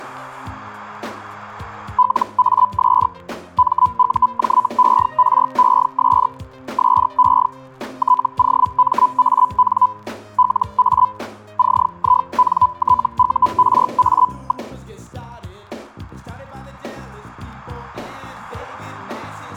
Hellschreiber (Feld-Hell, 122.5 baud), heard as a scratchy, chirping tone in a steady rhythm, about 1000 Hz. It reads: LAS MUJERES SE TOMAN LA CINTURA.